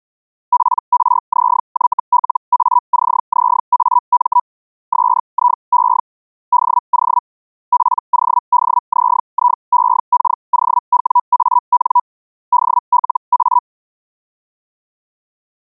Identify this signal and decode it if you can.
Hellschreiber (Feld-Hell, 122.5 baud), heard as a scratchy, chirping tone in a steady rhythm, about 980 Hz. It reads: PRZYLACZAM SIE DO PODZIEKOWAN DLA